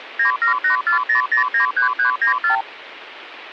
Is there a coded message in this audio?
Yes: multi-frequency trunk signalling (R2, with the far end's replies) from 0.2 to 2.6 s, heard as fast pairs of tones, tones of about 110 ms, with phone line noise. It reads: 97840093394